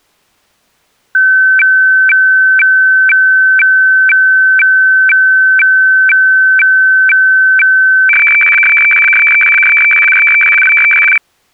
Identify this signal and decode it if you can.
Weather fax (radiofax), 120 lines a minute, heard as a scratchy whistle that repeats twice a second.